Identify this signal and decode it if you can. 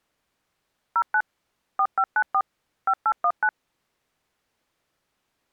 DTMF, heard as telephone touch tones, dialled by machine, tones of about 60 ms. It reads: 09 4594 5819